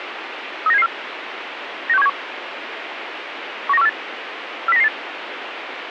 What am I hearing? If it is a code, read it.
Five-tone selective call (EEA), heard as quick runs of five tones, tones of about 40 ms, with radio hiss. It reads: 39774 96171 19148 40998